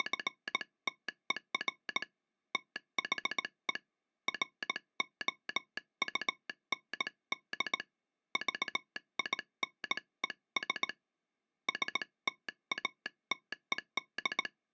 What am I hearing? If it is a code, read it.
Morse code, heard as a telegraph sounder, hand-sent with a paddle, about 18 wpm. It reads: … THE ROUND VINES STATED